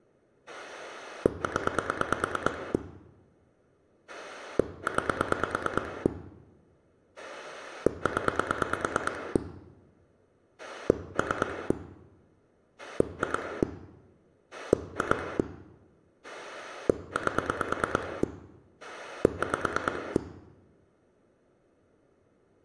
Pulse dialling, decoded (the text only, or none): 0 9 0 3 2 2 8 5